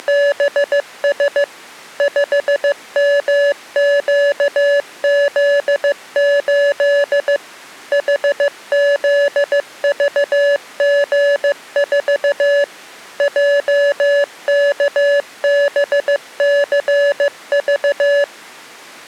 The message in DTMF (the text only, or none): none